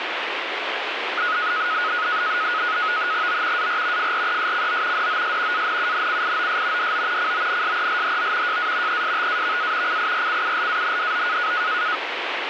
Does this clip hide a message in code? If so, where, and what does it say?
Yes: NAVTEX (SITOR-B), 100 baud, 170 Hz shift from 1.2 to 12.0 s, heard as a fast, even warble, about 1360 Hz centre, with radio static. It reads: O AR FRESCO DOS ANUNCIOS DO CONSELHO JA ESTAVA CIRCULANDO